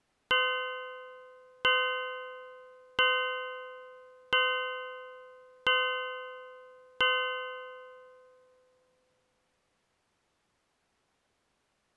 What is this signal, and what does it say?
Clock strike, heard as a bell. 6. Six o'clock.